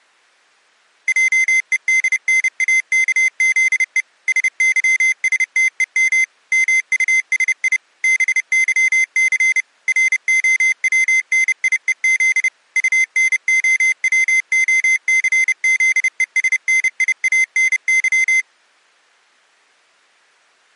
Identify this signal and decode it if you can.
Morse code, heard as a high beeper, machine-sent, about 30 wpm, 2050 Hz. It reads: JEDNAKZE SYSTEM MUSI BYC ROWNIEZ UNOWOCZESNIANY